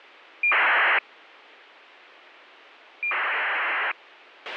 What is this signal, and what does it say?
ACARS aircraft data, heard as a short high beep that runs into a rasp, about 2400 baud, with a squelch burst at the end.